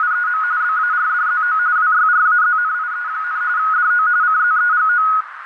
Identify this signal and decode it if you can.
RTTY (45.45 baud, 170 Hz shift), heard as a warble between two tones, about 1360 Hz centre, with radio static and a narrow filter. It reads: … BARDZO WYRAZNIE, DO CZEGO